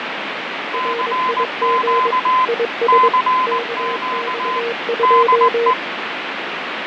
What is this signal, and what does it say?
Morse code, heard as two keyed tones, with heavy radio static and fading. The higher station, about 19 wpm, 1020 Hz: CQ CQ DE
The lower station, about 22 wpm, 470 Hz: RIG IS KX2